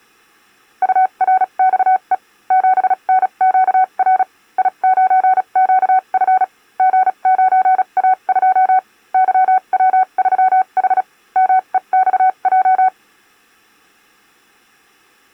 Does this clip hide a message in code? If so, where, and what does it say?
Yes: Morse code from 0.8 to 12.9 s, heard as a keyed tone, machine-sent, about 36 wpm, spaced as for 30 wpm, 750 Hz. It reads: URXE 7NQR I9QF G9A2 YW3H MEXJ